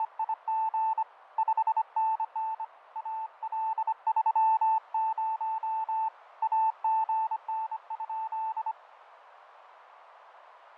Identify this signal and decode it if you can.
Morse code, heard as a keyed tone, hand-sent with a bug key, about 25 wpm, 880 Hz, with radio static and fading. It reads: … 5NN AL30 AGN?